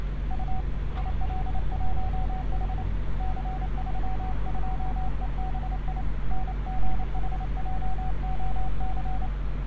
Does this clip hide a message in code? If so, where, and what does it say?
Yes: Morse code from 0.2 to 9.3 s, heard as a keyed tone, hand-sent with a paddle, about 28 wpm, 750 Hz, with street noise. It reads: U IL1H C32EBI NGHJOC